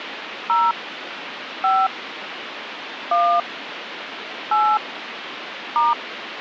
DTMF, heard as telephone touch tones, dialled by hand, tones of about 230 ms, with phone line noise. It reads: 0 5 1 8 *